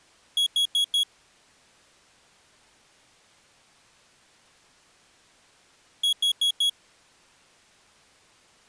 Alarm pattern, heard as an alarm's beeps, played twice, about 3350 Hz. Temporal four. Carbon monoxide.